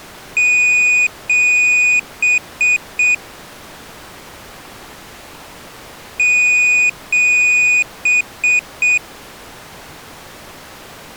Beep code, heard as a piezo beeper, played twice, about 2450 Hz. 2 long, 3 short.